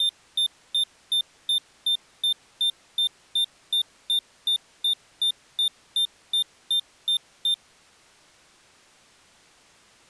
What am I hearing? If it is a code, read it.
Evenly repeated beeps. There is no code.